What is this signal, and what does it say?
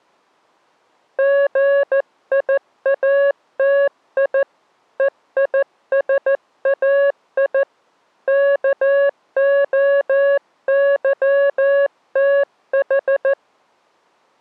Morse code (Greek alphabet), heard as a keyed tone, hand-sent with a paddle, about 14 wpm, 560 Hz. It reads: ΓΙΑΤΙ ΕΙΣΑΙ ΚΟΥΤΗ